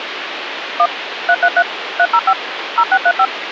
DTMF, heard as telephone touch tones, dialled by machine, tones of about 60 ms, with phone line noise. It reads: 1 333 305 0635